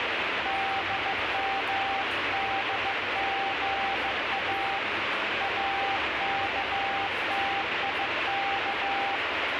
Morse code, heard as a keyed tone, hand-sent with a bug key, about 15 wpm, 790 Hz, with heavy radio static and the noise of a restaurant. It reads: DMDGA AKTIK